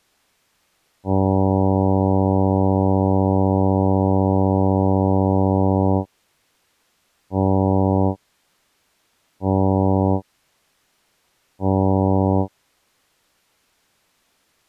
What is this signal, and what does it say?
Ship horn signal, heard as a ship's horn, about 100 Hz. 1 long, 3 short. At sea: a vessel under tow in fog.